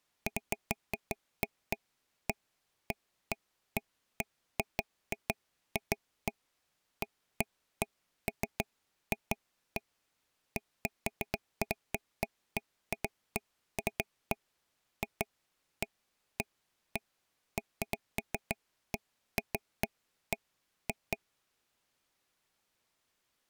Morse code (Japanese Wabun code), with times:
none

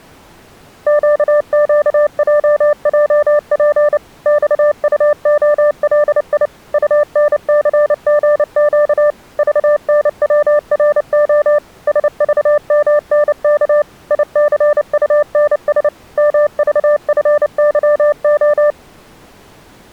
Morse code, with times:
0.9-4.0 QQJJP
4.3-6.5 XUOLI
6.7-9.1 UNCGQ
9.4-11.6 VNWRO
11.9-13.8 SVMNK
14.1-15.9 ICUNS
16.2-18.7 MVFYO

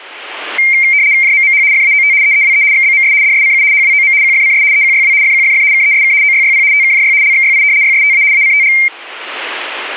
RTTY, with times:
1.2-1.6 JMMH
1.7-2.1 FAOT
2.2-2.6 EEWE
2.7-3.1 XBMS
3.2-3.6 DSCU
3.7-4.1 HWOM
4.2-4.6 QFCS
4.7-5.1 EQYW
5.2-5.6 FQFF
5.7-6.1 KESK
6.2-6.6 OYYP
6.7-7.1 TKJY
7.2-7.6 LXYI
7.8-8.2 YSTA
8.3-8.7 ACTG

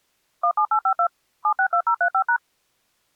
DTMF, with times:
0.4-1.1 17852
1.4-2.4 762035#

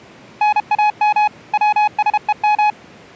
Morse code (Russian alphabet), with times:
0.4-1.3 НАМ
1.5-2.7 ВСЕМ

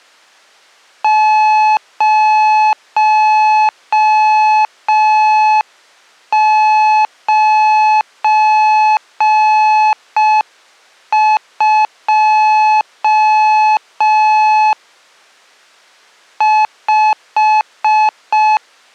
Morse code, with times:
1.0-14.7 092
16.4-18.6 5

